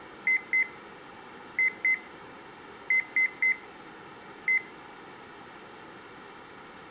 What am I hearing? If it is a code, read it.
Beep code, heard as beeps from a small speaker, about 2050 Hz. 2-2-3-1. In Phoenix BIOS tables: unexpected interrupt.